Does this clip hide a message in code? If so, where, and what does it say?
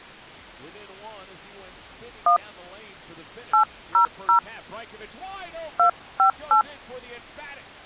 Yes: DTMF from 2.3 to 6.6 s, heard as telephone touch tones, dialled by hand, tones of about 100 ms. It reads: 1 800 258